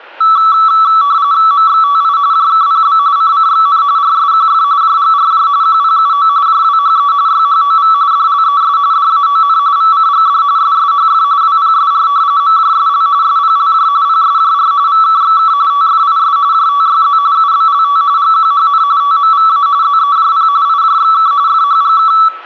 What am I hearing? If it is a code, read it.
RTTY (45.45 baud, 170 Hz shift), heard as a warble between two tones, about 1230 Hz centre, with static crashes and room echo. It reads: MXTI JKPB CCXN RSQF JGRJ QPUO JWHE YHOV DLES DAON VCGD SSHF WPSR MJSL SPLJ PSJR VKXK TFIS JTYZ UBLT GQHN TMVA ZEJP IJXK FHGK